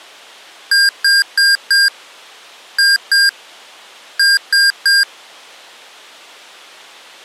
Beep code, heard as beeps from a small speaker, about 1600 Hz. 4-2-3. In Phoenix BIOS tables: gate A20 failure.